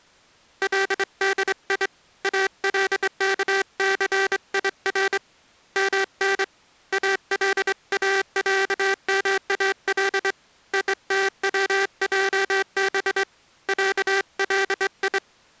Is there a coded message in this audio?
Yes: Morse code (Arabic alphabet) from 0.6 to 15.2 s, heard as a buzzer, hand-sent with a straight key, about 24 wpm. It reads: لدي الكثير من الاعمال يتوجب علي